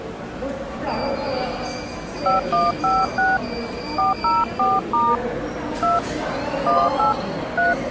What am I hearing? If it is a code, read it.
DTMF, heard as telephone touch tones, dialled by hand, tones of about 180 ms, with the noise of a subway station. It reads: 5156 404* 2 18 3